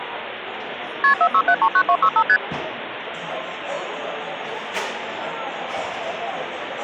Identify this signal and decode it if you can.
Multi-frequency trunk signalling (R1, as on North American trunks), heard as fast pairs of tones, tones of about 70 ms, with phone line noise and the noise of a cafe. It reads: KP 46739265 ST